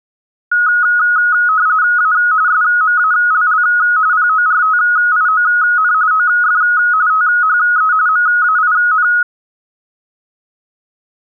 RTTY (45.45 baud, 170 Hz shift), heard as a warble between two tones, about 1360 Hz centre. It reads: A SMALL PORTION OF THE MAIN